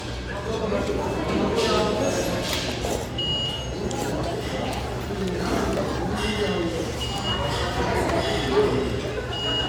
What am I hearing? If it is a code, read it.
The noise of a restaurant. There is no code.